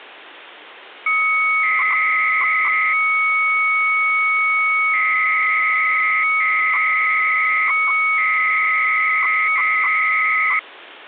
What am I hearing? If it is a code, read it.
300-baud modem data (Bell 103 tones), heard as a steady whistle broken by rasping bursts, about 300 baud, 200 Hz shift.